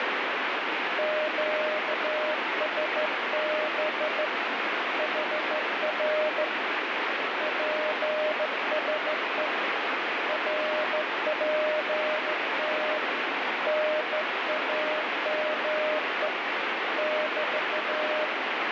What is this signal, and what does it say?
Morse code, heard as a keyed tone, hand-sent with a straight key, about 14 wpm, 610 Hz, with heavy radio static. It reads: QSB HR PSE RPT NAME <BT>